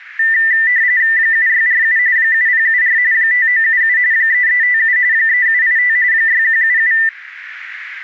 RTTY (45.45 baud, 170 Hz shift), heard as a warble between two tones, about 1900 Hz centre. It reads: 7647 7074 5977 3357 3785 6177